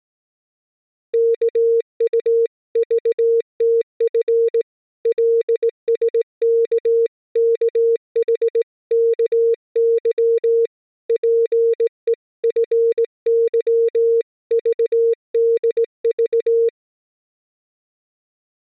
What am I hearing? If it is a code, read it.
Morse code (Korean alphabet), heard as a keyed tone, hand-sent with a straight key, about 18 wpm, 460 Hz. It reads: 이런 경우에 자네를